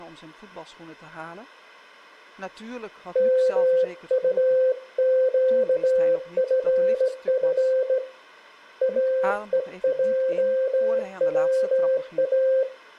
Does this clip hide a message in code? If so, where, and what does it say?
Yes: Morse code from 3.1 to 12.7 s, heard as a keyed tone, hand-sent with a straight key, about 17 wpm, 520 Hz. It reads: MUQFF AEJWA